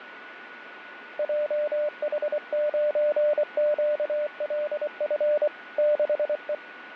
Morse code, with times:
1.2-5.5 JH9QLF
5.8-6.5 6E

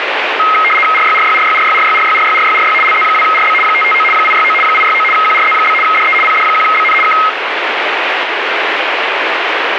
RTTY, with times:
0.9-2.7 RYRYRYRYRYRYRYRYRY
2.8-3.5 LZ2RB
3.6-4.0 559
4.1-4.5 869
4.6-5.0 869
5.1-5.7 QRZ?
5.8-6.1 DE
6.2-6.9 PD1BN
7.0-7.1 K

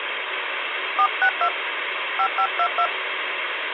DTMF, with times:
1.0-1.5 462
2.2-2.9 5522

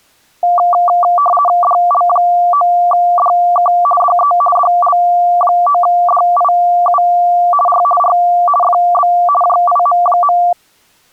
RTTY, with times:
1.6-3.7 DL9DK
4.0-4.3 DE
4.6-7.0 DL9DIU
7.7-7.8 R
8.0-8.1 R
8.6-9.1 FB
9.4-10.4 JIM.

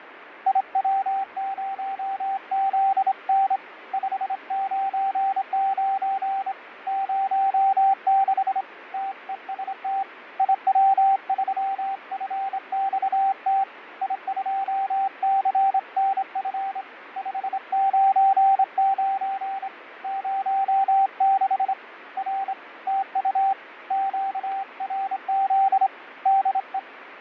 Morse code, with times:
0.5-3.6 IW0ZN
3.9-6.5 599
6.9-8.6 06
8.9-10.0 TEST
10.4-13.6 IW3FXT
14.0-16.8 I2CNF
17.2-19.7 599
20.0-21.7 06
22.2-22.5 R
22.9-23.5 TU
23.9-25.9 QRZ
26.3-26.8 DE

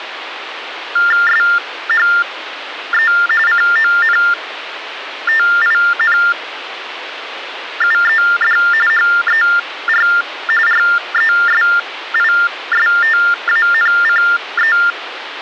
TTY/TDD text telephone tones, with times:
1.3-3.1 SHE
3.5-8.6 CONTINUED
8.9-10.1 HER
10.7-14.8 RESISTANCE

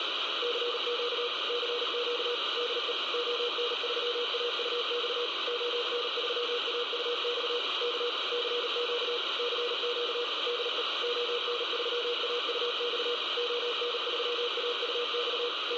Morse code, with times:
0.4-1.3 CQ
1.5-2.3 CQ
2.6-2.9 DE
3.1-5.3 ON3AUX
5.5-7.6 ON3AUX
7.8-8.1 K
8.3-9.2 CQ
9.4-10.2 CQ
10.5-10.8 DE
11.0-13.1 ON3AUX
13.4-15.5 ON3AUX
15.7-15.8 …

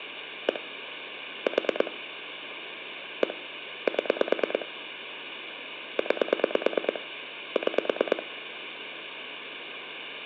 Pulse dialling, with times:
0.5-0.6 1
1.5-1.9 4
3.2-3.3 1
3.9-4.7 7
6.0-7.0 9
7.6-8.2 6

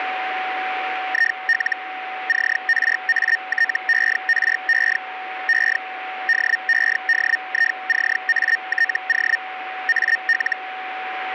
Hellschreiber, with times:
1.1-1.8 IL
2.3-5.0 CRATERE
5.5-5.8 E
6.3-9.4 DEDICATO
9.9-10.6 AL

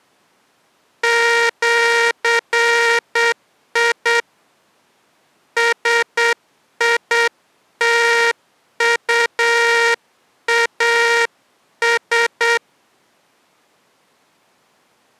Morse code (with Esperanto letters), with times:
1.0-4.2 ĜI
5.6-12.6 SITUAS

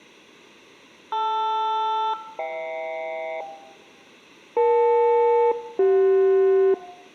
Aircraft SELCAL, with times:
1.1-3.4 LR-HK
4.6-6.7 EL-CJ

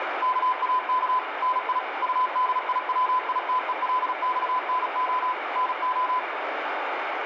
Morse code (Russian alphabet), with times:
0.2-1.2 КАК
1.4-1.8 НИ
2.0-5.3 УДИВИТЕЛЬНО
5.6-6.2 НО

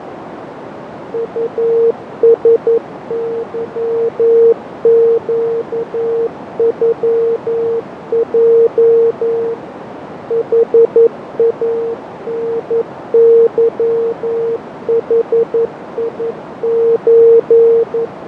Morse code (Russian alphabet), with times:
1.1-9.5 УСЫЩЮЙ
10.3-18.1 ХАНЫХИЧ

